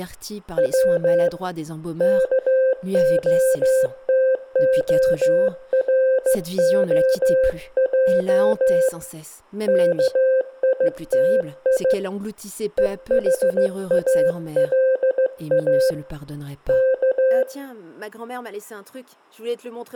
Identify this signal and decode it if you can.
Morse code (Russian alphabet), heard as a keyed tone, hand-sent with a straight key, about 15 wpm, 520 Hz, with room echo and speech in French. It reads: В КОТОРОЙ КИТИ ЕХАЛА К